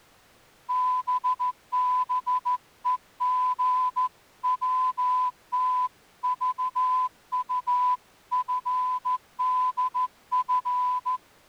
Morse code (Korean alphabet), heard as a whistle, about 14 wpm. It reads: 땃버리는